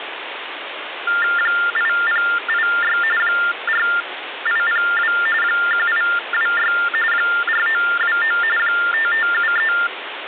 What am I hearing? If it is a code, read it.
TTY/TDD text telephone tones (45.45 baud Baudot), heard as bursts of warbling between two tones, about 400 Hz shift, 1600 Hz centre, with phone line noise. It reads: 8086 4802 1826 4929 5573